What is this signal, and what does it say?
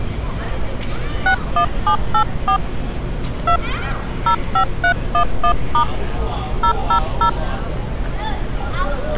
DTMF, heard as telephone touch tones, dialled by hand, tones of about 90 ms, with street noise. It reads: 61784 2 05311* 000